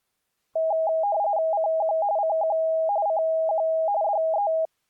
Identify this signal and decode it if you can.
RTTY (45.45 baud, 170 Hz shift), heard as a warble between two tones, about 730 Hz centre. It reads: CQ CQ CQ DE